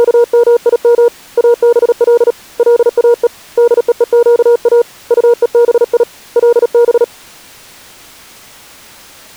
Morse code (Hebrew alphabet), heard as a keyed tone, hand-sent with a paddle, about 37 wpm, 470 Hz. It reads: … אבל לאו דווקא טובי לב